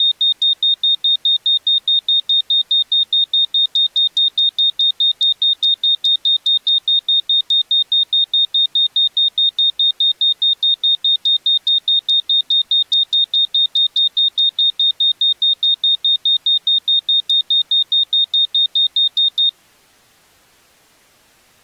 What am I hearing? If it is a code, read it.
Evenly repeated beeps. There is no code.